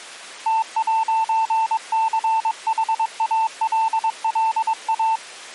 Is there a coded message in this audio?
Yes: Morse code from 0.4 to 5.2 s, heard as a keyed tone, hand-sent with a paddle, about 22 wpm, 890 Hz. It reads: T'CHALLA